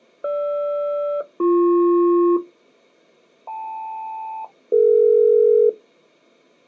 Aircraft SELCAL, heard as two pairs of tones. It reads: GR-BP KL-DE